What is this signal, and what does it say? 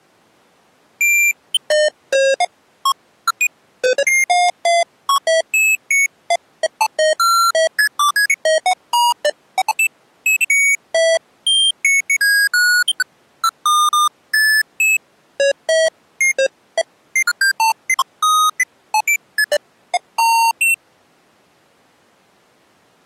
Electronic bleeps of random pitch and length. There is no code.